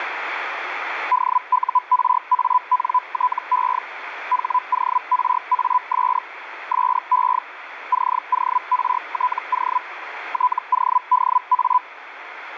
Hellschreiber (Feld-Hell, 122.5 baud), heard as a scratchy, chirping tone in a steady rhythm, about 1000 Hz, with radio static. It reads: DURANTE HORAS SE CORTO TODA